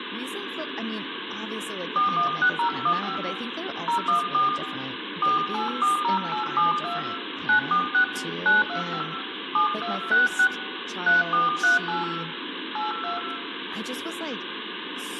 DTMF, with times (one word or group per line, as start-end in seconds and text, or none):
2.0-3.2 416015
3.9-4.5 014
5.2-7.0 4840872
7.5-8.0 946
8.5-9.0 925
9.5-10.5 7266
11.1-12.0 3438
12.8-13.2 82